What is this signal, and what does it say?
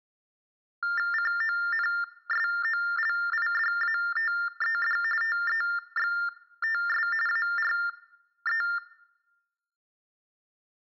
TTY/TDD text telephone tones (45.45 baud Baudot), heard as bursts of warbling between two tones, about 400 Hz shift, 1600 Hz centre. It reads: CONSOLIDATED TEXTS ARE